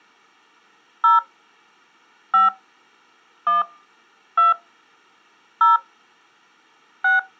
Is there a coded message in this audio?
Yes: DTMF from 1.0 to 7.2 s, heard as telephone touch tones, dialled by hand, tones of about 150 ms. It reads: 0 5 1 2 0 6